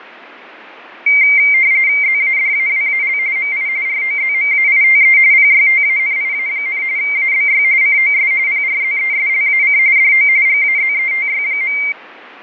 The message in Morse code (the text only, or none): none